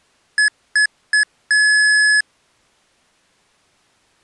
Beep code, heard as beeps from a small speaker, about 1700 Hz. 3 short, 1 long.